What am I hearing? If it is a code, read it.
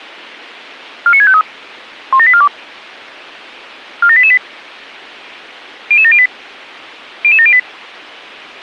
Five-tone selective call (ZVEI), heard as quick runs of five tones, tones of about 70 ms. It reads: 49653 17842 47888 00708 00708